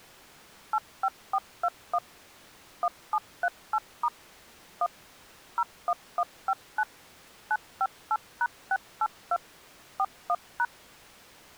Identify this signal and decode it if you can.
DTMF, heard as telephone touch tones, dialled by machine, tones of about 50 ms. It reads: 85421 1738* 1 01159 958#682 41#